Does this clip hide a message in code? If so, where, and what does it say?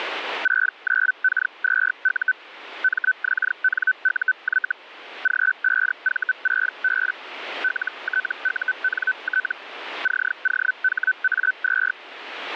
Yes: Hellschreiber (Feld-Hell, 122.5 baud) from 0.4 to 11.9 s, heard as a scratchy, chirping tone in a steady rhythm, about 1500 Hz, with radio static. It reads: 69K2U MXNUY G5V6B LTUNT COHA2